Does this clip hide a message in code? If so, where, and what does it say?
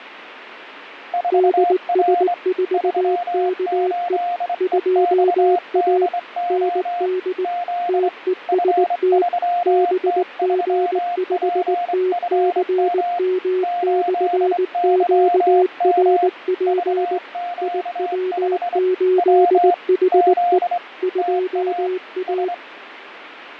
Yes: Morse code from 1.1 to 22.6 s, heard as two keyed tones, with radio static and fading. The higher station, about 24 wpm, 700 Hz: 4R 38EXDO Z F3T3PFM 8YM VQ5 W Z TA S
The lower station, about 19 wpm, 370 Hz: DS4KE 2A ND TEST BG5TCM/QRP IW8HE 2A